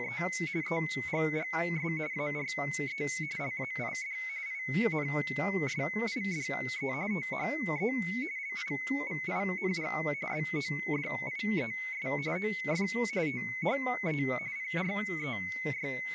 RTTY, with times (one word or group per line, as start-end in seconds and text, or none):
0.0-0.2 …
0.6-1.9 EGGS
2.1-3.0 ARE
3.4-4.2 LAID
4.5-6.9 INSIDE
7.1-7.9 THE
8.4-9.9 LIVING
10.3-12.1 BODIES
12.4-12.9 OF
13.3-14.2 THE
14.6-16.1 …